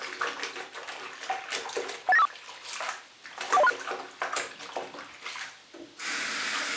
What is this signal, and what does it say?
Five-tone selective call (EIA), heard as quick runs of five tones, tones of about 30 ms, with the noise of a restroom. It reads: 18954 41036